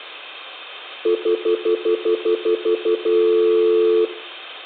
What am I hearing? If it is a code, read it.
Telephone call progress tone (North American plan), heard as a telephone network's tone, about 350, 440 Hz, 0.1 s on and 0.1 s off, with room echo. Stutter dial tone.